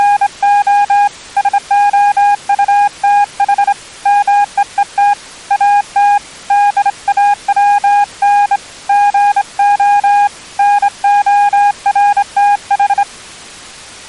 Morse code, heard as a keyed tone, hand-sent with a straight key, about 26 wpm, 820 Hz. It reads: … SOUTH MEET AT DAWN GO NORTH